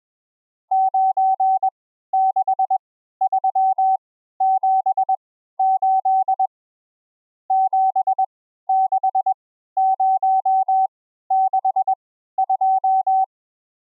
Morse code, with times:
0.7-6.5 96378
7.5-13.2 76062

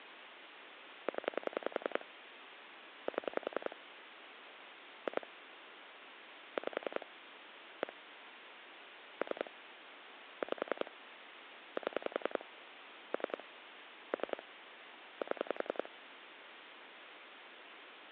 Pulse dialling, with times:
1.1-2.0 0
3.1-3.8 7
5.1-5.3 2
6.6-7.1 5
7.8-7.9 1
9.2-9.5 3
10.4-10.9 5
11.8-12.4 7
13.1-13.4 3
14.1-14.4 3
15.2-15.9 7

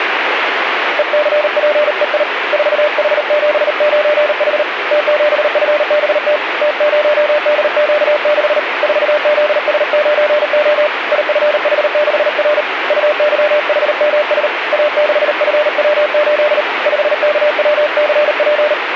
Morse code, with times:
1.0-2.2 ECPEI
2.5-4.6 4H79H
4.9-6.4 T7FBT
6.6-8.6 T0DQ6
8.8-10.9 4ZS9O
11.1-12.6 IFH6R
12.9-14.5 UYHMS
14.7-16.6 A6FW8
16.9-18.7 5KWCP

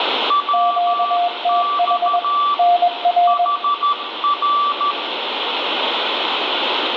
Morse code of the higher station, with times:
0.3-2.5 WX
3.3-4.9 HR

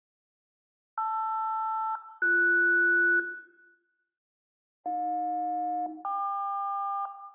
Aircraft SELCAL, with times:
1.0-3.2 LR-BS
4.9-7.1 AJ-KQ

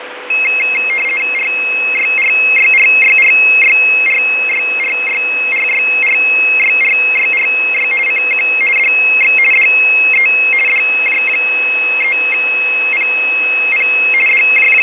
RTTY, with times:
1.3-7.9 RYRYRYRYRYRYRYRYRYRY
8.1-8.5 CQ
8.8-9.4 DX
9.5-10.3 DE
10.7-13.9 DJ3PP
14.3-14.8 …

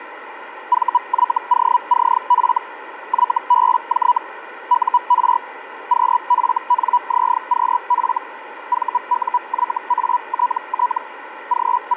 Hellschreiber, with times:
0.7-2.6 VYOCF
3.1-4.2 YBJ
4.7-5.4 UR
5.9-8.2 QFNZQF
8.7-11.0 VUYATT
11.5-12.0 …

